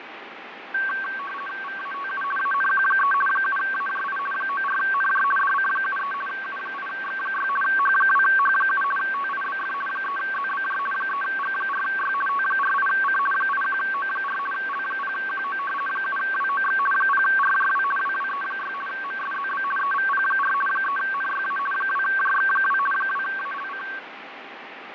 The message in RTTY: VATU ANQ3 7AJI 94NJ DC73 U8X6 H2H7 TIBF 3ZBJ 3G4Y T48C 81O4 L0QO 7WOX 0RJW WWE6 MSZB EVP4 3NYA 2JX2 2ALC

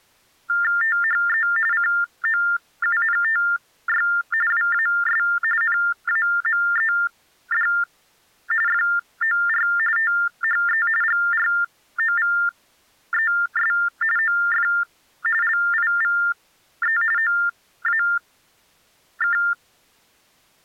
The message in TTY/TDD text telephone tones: THE COUNTY WAS NAMED FOR THE GROVES OF LIVE OAK

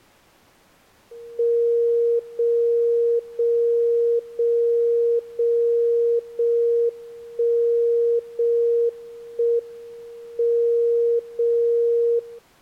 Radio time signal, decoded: 0 0 0 0 0 1 0 1 M 0 0

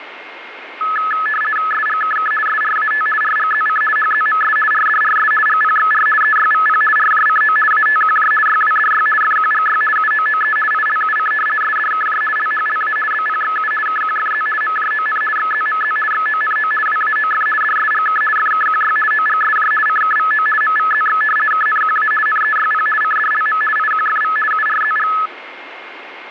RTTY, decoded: SGKK SRAT RGZC HZMS RDRS GPXR EYVP RJCO ATQJ YWDY FQGY UOOE ILUC SDKJ LHLA BPXU KQFZ MJON XZMZ XONO WAOF DSGK FKQY OGSJ CKVO MVZX KNQA NEYP CDLM IQFV URZG

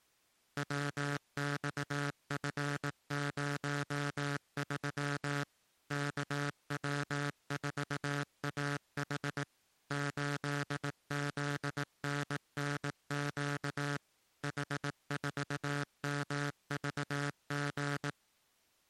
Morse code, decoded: WXF03 KW4AH 8ZNNQ H4MVG

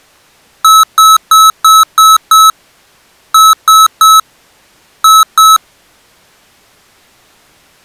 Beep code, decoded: 6-3-2

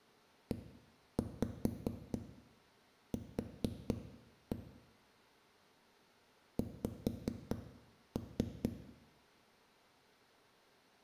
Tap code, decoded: EQ X

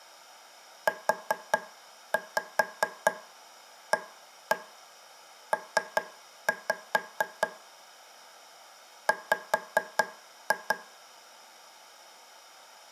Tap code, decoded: UAP W

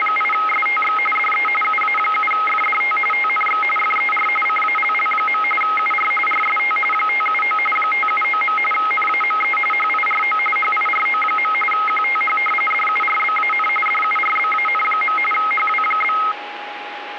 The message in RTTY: … DE UA7FDT TNX FER CALL. UR RST 579 579. NAME HIRO HIRO. QTH DURBAN DURBAN. HW?

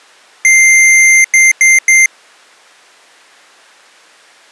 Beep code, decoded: 1 long, 3 short

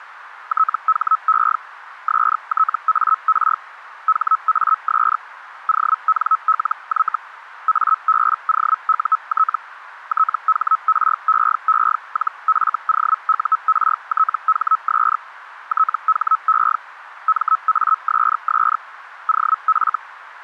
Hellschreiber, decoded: THE STAR HAS ONLY ABOUT THREE-FOURTHS THE MASS OF

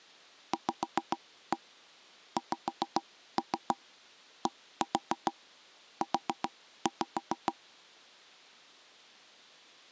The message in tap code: VXDU

